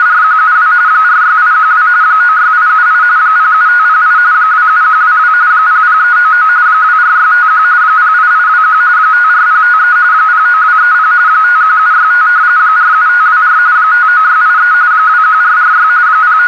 RTTY (45.45 baud, 170 Hz shift), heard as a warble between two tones, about 1360 Hz centre, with radio static and a narrow filter. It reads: … 46812 96878 07508 27122 00399 24651 08821 54053 09230 51765 47524 59683 21446 …